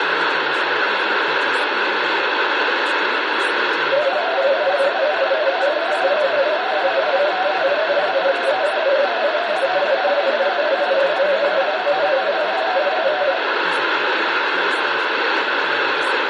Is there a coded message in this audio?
Yes: multi-tone FSK (Olivia or MFSK type), about 250 Hz wide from 3.9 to 13.4 s, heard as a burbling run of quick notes, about 31.25 baud, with radio static, room echo and speech in English.